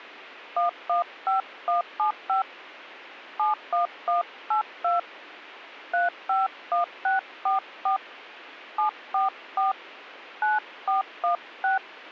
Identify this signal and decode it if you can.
DTMF, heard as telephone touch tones, dialled by hand, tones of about 140 ms. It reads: 115175 71182 351644 744 9416